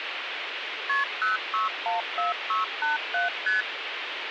Multi-frequency trunk signalling (R1, as on North American trunks), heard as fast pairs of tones, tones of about 150 ms, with phone line noise. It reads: KP 0614687 ST